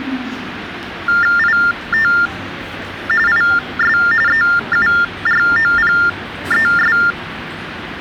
TTY/TDD text telephone tones (45.45 baud Baudot), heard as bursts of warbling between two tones, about 400 Hz shift, 1600 Hz centre, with phone line noise and the noise of a subway station. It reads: IT IS EUROPES